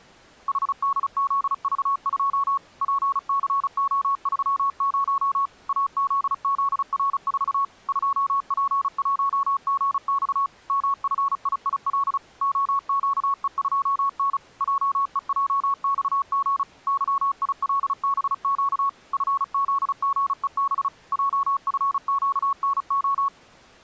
Morse code, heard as a keyed tone, machine-sent, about 35 wpm, 1110 Hz. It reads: HDZV2 PCO30 AZZR4 2P1GX MFIIL OQE2N JEJXG YILBQ FZGEB JFQNO